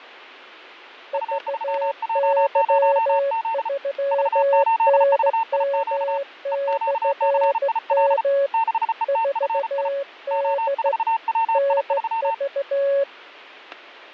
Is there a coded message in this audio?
Yes: Morse code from 1.1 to 13.1 s, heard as two keyed tones, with fading and static crashes. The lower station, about 15 wpm, 560 Hz: VY3NM/M 4D NV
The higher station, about 34 wpm, 900 Hz: U3J0Z V8VIQ EQCIL 6ETFI O4WI3